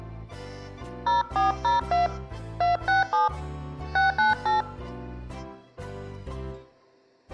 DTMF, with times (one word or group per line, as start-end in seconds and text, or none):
1.1-2.1 0402
2.6-3.3 267
4.0-4.6 698